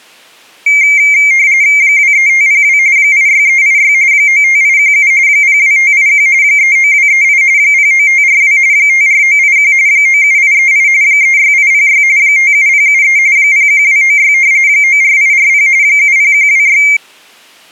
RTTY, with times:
1.8-2.8 23502
3.0-3.9 86386
4.1-5.1 95817
5.3-6.3 02581
6.4-7.4 39238
7.6-8.6 09542
8.7-9.7 54981
9.9-10.9 97838
11.0-12.0 36806
12.2-13.2 57073
13.4-14.3 01296
14.7-15.7 94840
15.8-16.8 70126

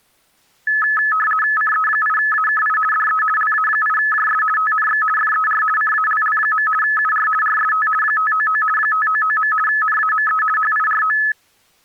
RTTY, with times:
1.6-2.8 CE8AKI
2.9-3.2 DE
3.4-4.4 LA8JS
4.6-5.0 TNX
5.2-5.6 FER
5.8-6.7 CALL.
6.8-7.3 UR
7.4-7.9 RST
8.0-8.6 599
8.8-9.5 599.
9.7-10.4 NAME
10.6-11.2 HIRO

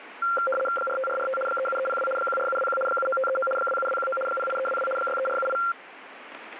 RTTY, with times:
0.8-1.4 45445
1.5-2.1 37302
2.2-2.8 14721
2.9-3.5 79539
3.6-4.2 27219
4.3-4.9 08322
5.0-5.6 63478

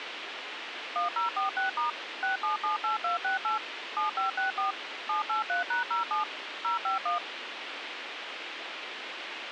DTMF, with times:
1.0-1.9 1046*
2.2-3.6 6778268
4.0-4.7 7564
5.1-6.2 783#07
6.6-7.2 051

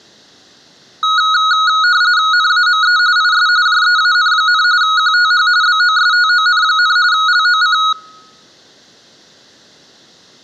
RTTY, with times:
2.3-3.0 NAME
3.2-3.5 IS
3.7-4.6 JEAN,
4.8-5.5 QTH
5.6-7.0 BOSTON,
7.1-7.8 LOC

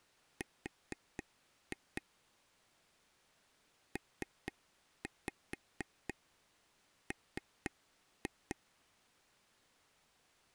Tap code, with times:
0.4-2.0 R
4.0-8.6 PM

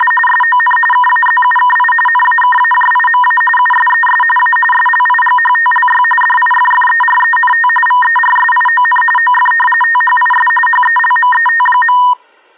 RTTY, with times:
0.0-0.1 …
0.3-0.8 SON
0.9-1.9 KAZUKI
2.1-3.4 NAKAJIMA
3.6-4.2 USES
4.4-4.6 A
4.7-6.0 SLIGHTLY
6.2-7.7 DIFFERENT
7.9-9.0 VERSION
9.2-9.5 OF
9.8-10.5 THIS
10.7-12.0 HELMET.

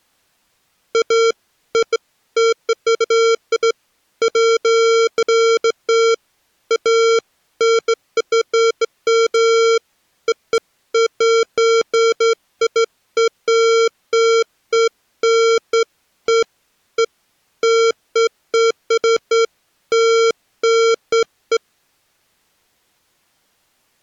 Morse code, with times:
none

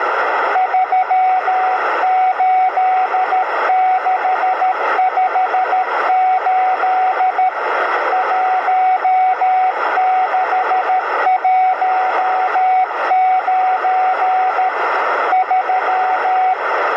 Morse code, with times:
0.6-7.5 38658
8.1-14.7 1619
15.3-16.5 3

